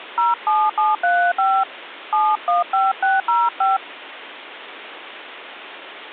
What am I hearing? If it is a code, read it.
DTMF, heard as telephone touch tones, dialled by hand, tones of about 220 ms, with phone line noise. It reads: 07735 715605